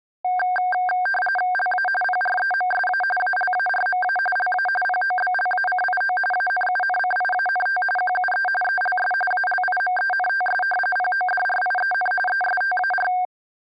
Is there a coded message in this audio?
Yes: RTTY (45.45 baud, 850 Hz shift) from 0.2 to 13.3 s, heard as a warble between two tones, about 1160 Hz centre. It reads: LA PREMSA ALARMA LA POBLACIO ANUNCIANT QUE ELS ALIMENTS PODRIEN ESTAR